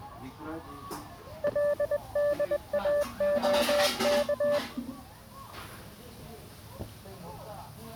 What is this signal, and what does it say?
Morse code, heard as a keyed tone, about 21 wpm, 580 Hz, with the noise of a restaurant. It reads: LDAOK